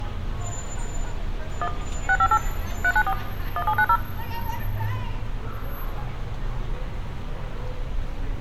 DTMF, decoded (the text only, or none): 1 658 394 1790